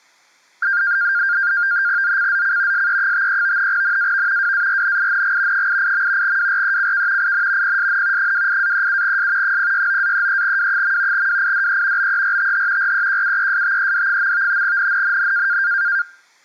NAVTEX (SITOR-B), 100 baud, 170 Hz shift, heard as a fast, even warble, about 1500 Hz centre. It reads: ZCZC SE53 NAV WARNING 88. WRECK IN PSN 28-37S 069-33W. WIDE BERTH REQUESTED. NNNN